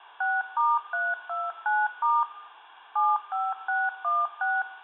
DTMF, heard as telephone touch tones, dialled by machine, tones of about 210 ms, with room echo. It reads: 6*329* 75616